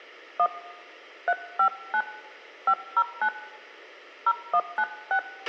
DTMF, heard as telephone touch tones, dialled by hand, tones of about 70 ms, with a squelch burst at the end and room echo. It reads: 1 359 509 0196